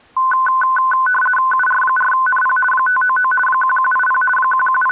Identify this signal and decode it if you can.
RTTY (50 baud, 450 Hz shift), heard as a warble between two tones, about 1270 Hz centre. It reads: UR4NP 599 1180 …